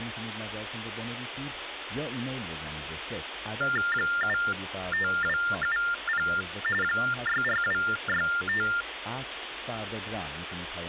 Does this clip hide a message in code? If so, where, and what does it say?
Yes: TTY/TDD text telephone tones (45.45 baud Baudot) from 3.6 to 8.8 s, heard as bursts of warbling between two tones, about 400 Hz shift, 1600 Hz centre, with phone line noise. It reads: 75270 64265